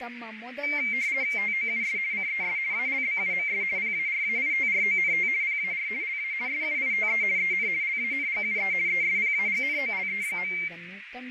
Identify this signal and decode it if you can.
RTTY (50 baud, 170 Hz shift), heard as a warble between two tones, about 2200 Hz centre, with radio static, a narrow filter and speech in Kannada. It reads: TOUS CES ALBUMS PARAITRONT PAR LA SUITE EN LANGUE ESPAGNOLE.